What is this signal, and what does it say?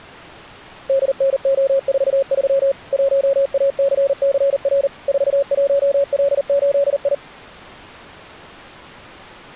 Morse code, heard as a keyed tone, machine-sent, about 39 wpm, 550 Hz. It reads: DNO43 1ACCR 41L8I